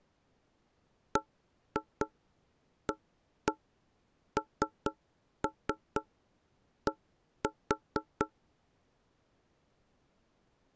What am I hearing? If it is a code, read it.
Tap code, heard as knocks on wood, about 4 knocks a second. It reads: BAND